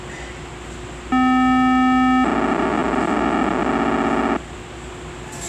POCSAG pager data (512 baud), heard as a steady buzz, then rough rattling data, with the noise inside a subway train.